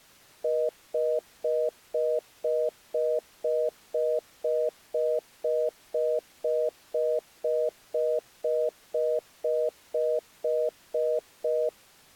Telephone call progress tone (North American plan), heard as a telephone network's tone, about 480, 620 Hz, 0.25 s on and 0.25 s off. Congestion tone.